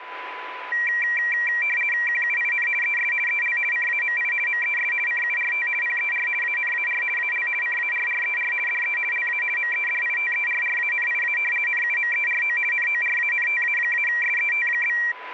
RTTY (50 baud, 450 Hz shift), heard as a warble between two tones, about 2100 Hz centre, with radio static and a steady whistle near 1000 Hz. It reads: QUIN ES EL CAMI MES CURT PER ANAR AL CARRER DE LA MEDITERRANIA NUMERO NORANTA-SET?